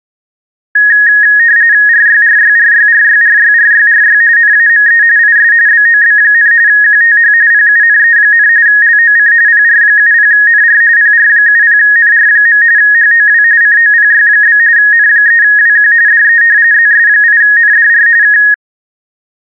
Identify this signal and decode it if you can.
RTTY (45.45 baud, 170 Hz shift), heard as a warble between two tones, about 1750 Hz centre. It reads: RYRYRYRYRYRYRY NAME IS BOB, QTH PUNE, LOC PR70NR PR70NR. HOW COPY? N3WQ DE ZS8NDR K